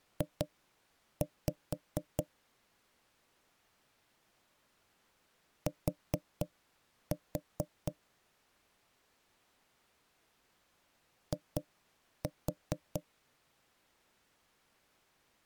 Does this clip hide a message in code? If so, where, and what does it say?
Yes: tap code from 0.2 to 13.1 s, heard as knocks on wood, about 4 knocks a second. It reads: J T I